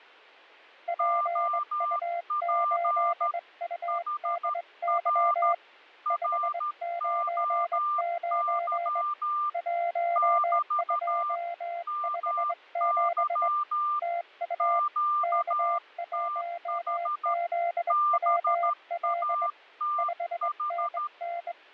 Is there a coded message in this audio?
Yes: Morse code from 0.8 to 21.6 s, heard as two keyed tones, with fading. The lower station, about 21 wpm, 690 Hz: PU8UDY 599 1257 TU K1ZWL 5NN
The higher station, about 13 wpm, 1190 Hz: OP HR ROY <BT> MY QTH BATH